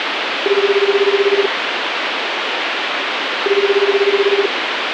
Telephone call progress tone (Japanese plan), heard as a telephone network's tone, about 380, 400, 420 Hz, 1 s on and 2 s off, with phone line noise. Ringback tone.